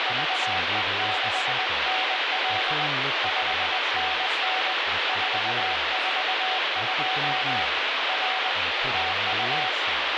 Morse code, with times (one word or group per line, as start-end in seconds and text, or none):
0.1-2.9 VE6NL
3.2-4.7 5NN
5.1-7.6 442
8.1-8.5 R
8.9-9.7 TU